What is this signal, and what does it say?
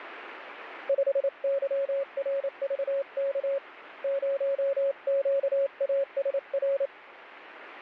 Morse code, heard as a keyed tone, hand-sent with a paddle, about 28 wpm, 550 Hz, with radio static. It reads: 5YRVK 0QASR